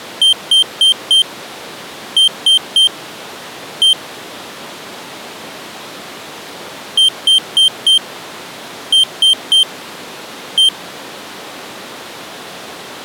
Beep code, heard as a piezo beeper, played twice, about 3150 Hz. 4-3-1. In Phoenix BIOS tables: memory failure above the first 64 KB.